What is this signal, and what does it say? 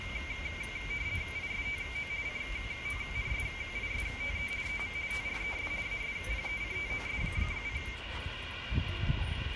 RTTY (50 baud, 170 Hz shift), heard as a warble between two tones, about 2200 Hz centre, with radio static, room echo and the noise of a residential street. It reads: ISTO CONSISTE EM TRES ASPECTOS: